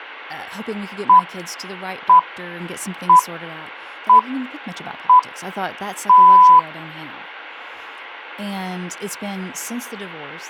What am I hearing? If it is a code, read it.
Radio time signal (six pips, as the Greenwich Time Signal), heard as pips, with speech in English.